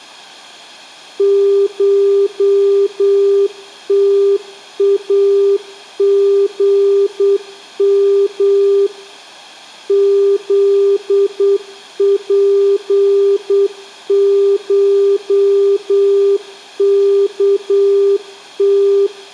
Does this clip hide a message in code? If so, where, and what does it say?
Yes: Morse code (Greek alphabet) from 1.1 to 19.1 s, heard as a keyed tone, machine-sent, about 8 wpm, 400 Hz. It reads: ΧΤΑΓΜ ΖΠΧΚΤ